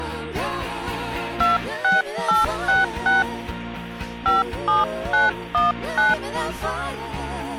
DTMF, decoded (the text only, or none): 26866 57919